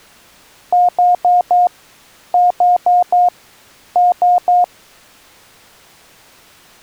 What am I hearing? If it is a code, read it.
Beep code, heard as beeps, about 710 Hz. 4-4-3. In Phoenix BIOS tables: maths coprocessor failure.